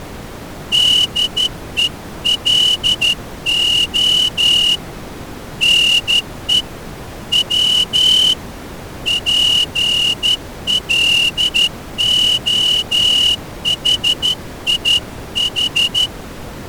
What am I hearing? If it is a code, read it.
Morse code (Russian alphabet), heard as a whistle, hand-sent with a straight key, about 12 wpm. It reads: ДЕЛО НЕ В ПЛОХИХ